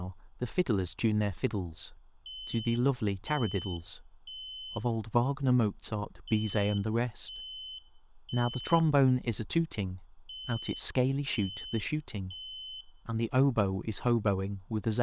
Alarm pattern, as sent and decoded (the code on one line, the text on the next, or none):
3 beeps and a pause
temporal three